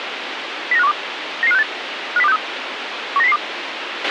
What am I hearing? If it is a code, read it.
Five-tone selective call (EEA), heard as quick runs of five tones, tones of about 40 ms, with radio hiss and a squelch burst at the end. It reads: 09512 99568 50263 19002